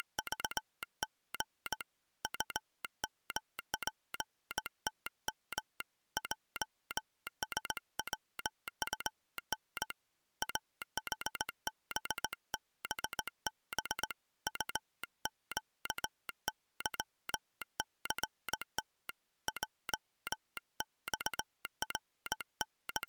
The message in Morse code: … UMPTM JSWUN AHBBB UQYCT …

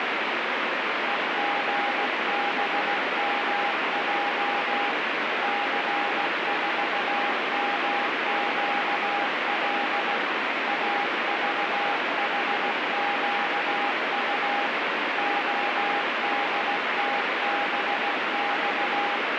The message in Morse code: EGBMJ C4MQL AVHQU ODTBX

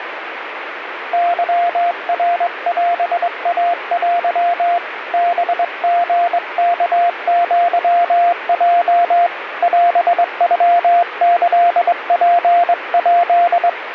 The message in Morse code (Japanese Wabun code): ケナオイテ ハリワアヲ オノキツヱ

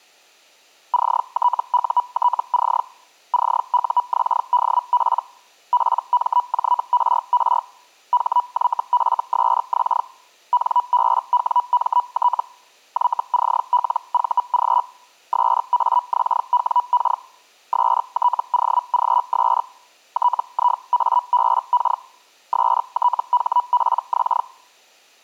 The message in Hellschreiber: CTUTC CUXDP PMJRR HYFSX NBWMT YCLVG SAXWK STOGS TIABK STHPX

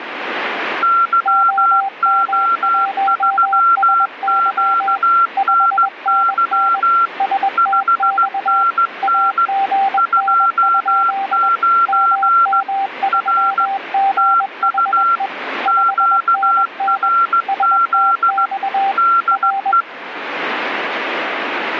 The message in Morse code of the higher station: YO3QNY 5NN 29 R TU QRZ DE

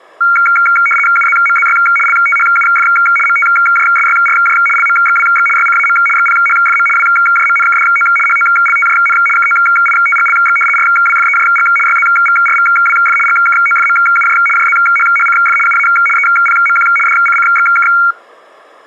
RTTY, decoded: UZMZY LTHUF MTJSYRJ LMXWX YCAM XPHFM WJMNKDO HOLTJN KOITGLX RWFEJG YZVRVWF GKOFMUJ JZHHCF UA EPMQ DCCXK

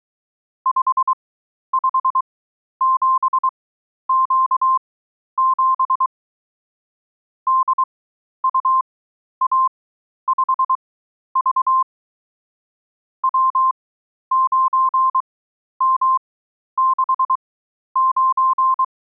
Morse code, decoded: 557Q7 DUA5V W9M69

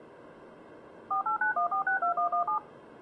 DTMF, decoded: 4891462117

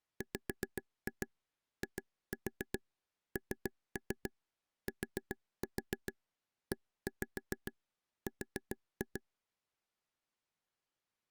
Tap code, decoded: WINTER

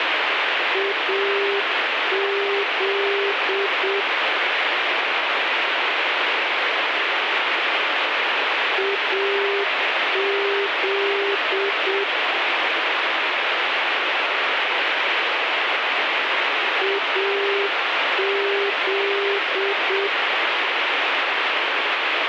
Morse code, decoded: AZ AZ AZ

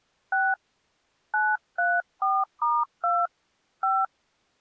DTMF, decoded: 6 934*2 5

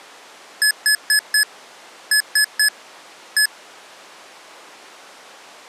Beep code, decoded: 4-3-1

